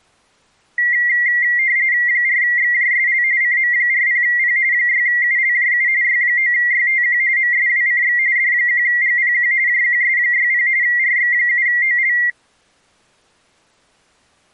RTTY (45.45 baud, 170 Hz shift), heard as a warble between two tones, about 2000 Hz centre. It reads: 4XJSL CM40P 6ULJU Y9YTQ MSWCX D1GPQ JQS60 RX7OL